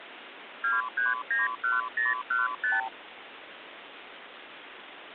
Multi-frequency trunk signalling (R2, with the far end's replies), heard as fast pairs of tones, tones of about 170 ms, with phone line noise. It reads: 2391015